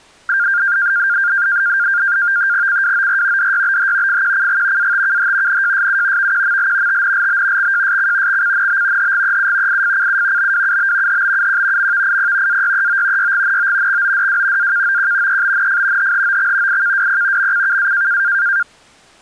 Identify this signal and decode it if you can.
NAVTEX (SITOR-B), 100 baud, 170 Hz shift, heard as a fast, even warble, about 1500 Hz centre. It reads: CWOR DYBH FQCG ATKH NJSU VQML TNLB XJSC XCNB HGEU IFCU BWUB HBUQ MVIP AYEO YGNO XODW AKOQ EBNF HHOX IKWP MCKA